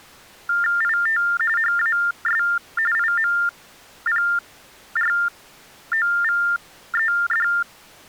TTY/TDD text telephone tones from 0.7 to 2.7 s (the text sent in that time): IT HAS